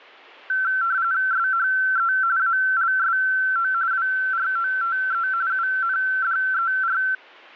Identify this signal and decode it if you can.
RTTY (45.45 baud, 170 Hz shift), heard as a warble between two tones, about 1440 Hz centre. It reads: SHE ALSO WROTE UNDER